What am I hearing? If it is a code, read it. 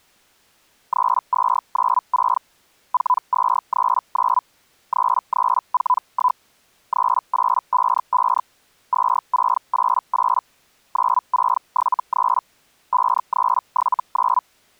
Hellschreiber (Feld-Hell, 122.5 baud), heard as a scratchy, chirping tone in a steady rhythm, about 1000 Hz. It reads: 3296 4239 3341 3855 2688 9673 5379